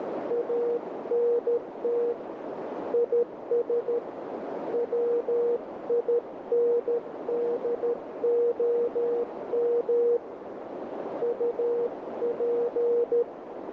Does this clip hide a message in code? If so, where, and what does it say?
Yes: Morse code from 0.2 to 13.3 s, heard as a keyed tone, hand-sent with a paddle, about 13 wpm, 480 Hz, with heavy radio static and a narrow filter. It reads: ANT IS WINDOM UP